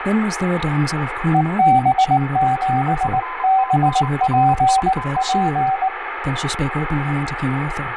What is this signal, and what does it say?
Morse code, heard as two keyed tones, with radio static, room echo and speech in English. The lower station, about 19 wpm, 770 Hz: EB7BPP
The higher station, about 26 wpm, 1020 Hz: FTNRIO